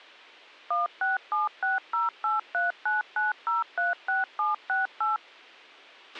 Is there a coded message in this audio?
Yes: DTMF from 0.7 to 5.2 s, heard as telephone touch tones, dialled by machine, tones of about 160 ms, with a squelch burst at the end. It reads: 167608399036768